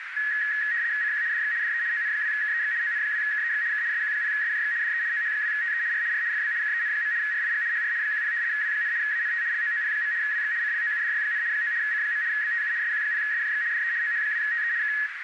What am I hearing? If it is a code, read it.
RTTY (75 baud, 170 Hz shift), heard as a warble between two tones, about 1800 Hz centre, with radio static and a narrow filter. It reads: CQ DX DE ON2KEX ON2KEX K SQ0SJX DE OH2TE R R FB KEN. RIG HR 10 W, ANT LOOP. WX CLOUDY, 9 C. BTU SQ0SJX DE OH2TE K